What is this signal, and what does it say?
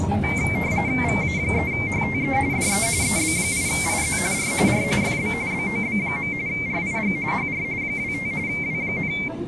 RTTY (45.45 baud, 170 Hz shift), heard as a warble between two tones, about 2200 Hz centre, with static crashes and the noise inside a bus. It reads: VA3HTE DE EB8IZ R R FB BOB. RIG HR 25 W,